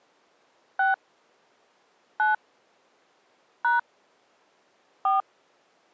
DTMF, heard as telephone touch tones, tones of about 150 ms. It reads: 6 9 # 4